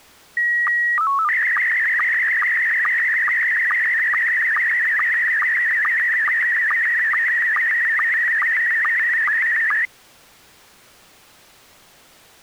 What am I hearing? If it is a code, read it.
SSTV (slow-scan television), Scottie S1, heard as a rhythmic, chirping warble.